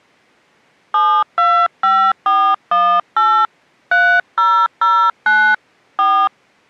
DTMF, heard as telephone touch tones, dialled by hand, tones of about 280 ms. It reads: 725418 3009 4